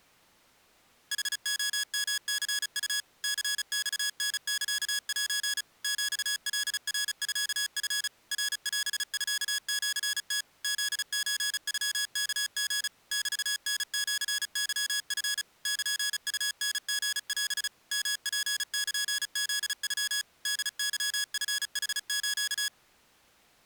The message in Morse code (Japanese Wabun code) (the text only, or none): ヌレヨニウ ニマタサセ ヒカナミチ ナオミシム フソノワリ メタシケチ ルウタリオ ヨツルフノ ホケチヌス